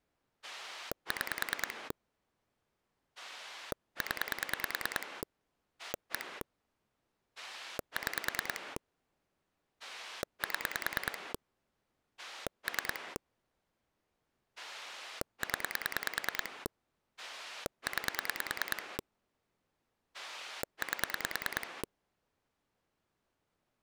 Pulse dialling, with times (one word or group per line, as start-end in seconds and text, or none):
0.4-1.9 6
3.2-5.2 0
5.8-6.4 1
7.4-8.8 6
9.8-11.3 7
12.2-13.2 3
14.6-16.7 0
17.2-19.0 9
20.1-21.8 8